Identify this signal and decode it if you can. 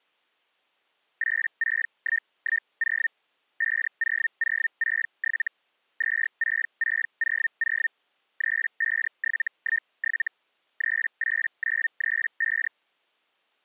Hellschreiber (Feld-Hell, 122.5 baud), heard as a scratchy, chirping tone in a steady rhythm, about 1800 Hz. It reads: 86110 50067 26600 35717 38935